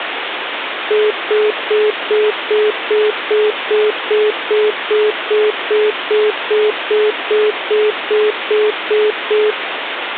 Telephone call progress tone (single-tone plan, as in most of Europe), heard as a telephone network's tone, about 420 Hz, 0.2 s on and 0.2 s off, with phone line noise. Congestion tone.